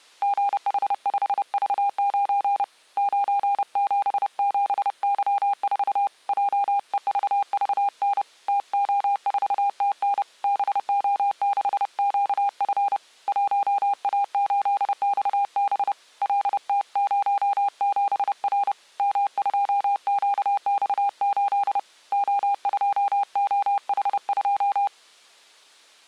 Morse code, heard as a keyed tone, hand-sent with a paddle, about 30 wpm, 800 Hz. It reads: GH5V9 977Y4 JEVVN TO4TN BO6QF 1A8XB LT07R M2QX8 O2OH2